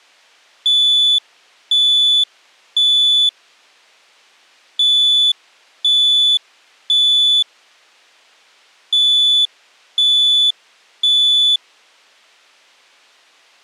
Alarm pattern, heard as an alarm's beeps, played three times, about 3450 Hz. Temporal three. Smoke or fire, evacuate.